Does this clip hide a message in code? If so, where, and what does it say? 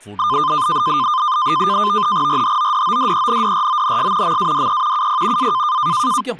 Yes: NAVTEX (SITOR-B), 100 baud, 170 Hz shift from 0.2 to 6.2 s, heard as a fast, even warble, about 1120 Hz centre, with static crashes and speech in Malayalam. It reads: RHODODENDRONS MADE UP A